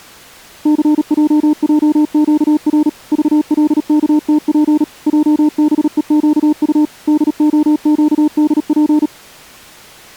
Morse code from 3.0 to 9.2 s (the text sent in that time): VLKTP JBEQU DOQDP